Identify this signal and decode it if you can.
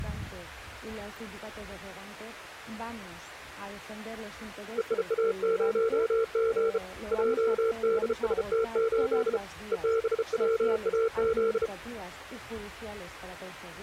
Morse code, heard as a keyed tone, hand-sent with a bug key, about 33 wpm, 450 Hz. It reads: EIA0G JDST8 EBWAZ